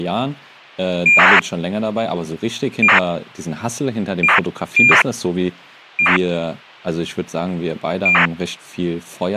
ACARS aircraft data, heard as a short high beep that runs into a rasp, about 2400 baud, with speech in German.